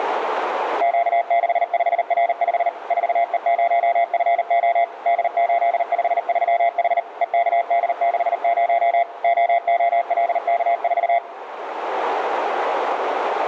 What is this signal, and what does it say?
Morse code, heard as a keyed tone, machine-sent, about 39 wpm, 690 Hz, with radio static and a narrow filter. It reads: Q65R5 4E0FO D853H EKD60 OOLK4